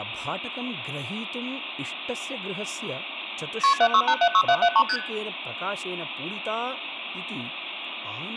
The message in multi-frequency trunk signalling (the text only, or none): KP 76876773 ST